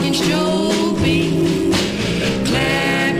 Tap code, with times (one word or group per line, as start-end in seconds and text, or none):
none